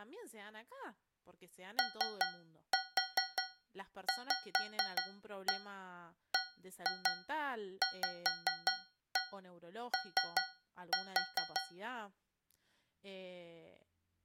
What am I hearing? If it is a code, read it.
Tap code, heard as taps on a metal pipe, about 5 knocks a second, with speech in Spanish. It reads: OVBVO